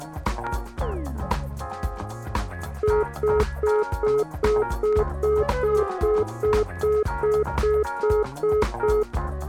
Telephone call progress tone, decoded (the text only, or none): congestion tone